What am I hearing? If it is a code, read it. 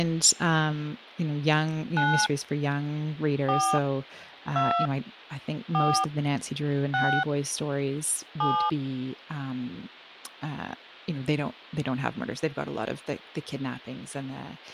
DTMF, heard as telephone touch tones, dialled by hand, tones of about 300 ms, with speech in English. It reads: 9 4 2 4 6 7